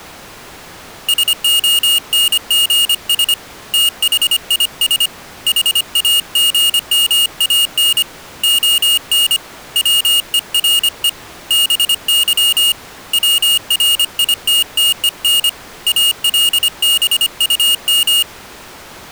Morse code, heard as a high beeper, hand-sent with a paddle, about 25 wpm, 2850 Hz. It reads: SONGS THIS HAGMAN ON WERE BY WRITTEN ALBUM